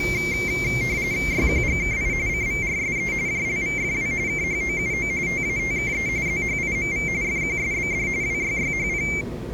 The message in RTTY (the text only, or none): YQGKI CVRSE JLVFW KHOUO TATKE ZHIMV FQSBD WYYHP